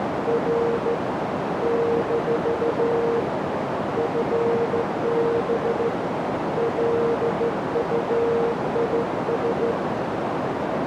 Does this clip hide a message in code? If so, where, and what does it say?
Yes: Morse code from 0.2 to 9.8 s, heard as a keyed tone, hand-sent with a straight key, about 14 wpm, 460 Hz, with heavy radio static and a narrow filter. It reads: R - FB LUIS